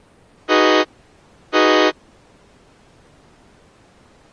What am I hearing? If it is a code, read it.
Train horn signal, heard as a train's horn. 2 short. On North American railways: a signal is acknowledged.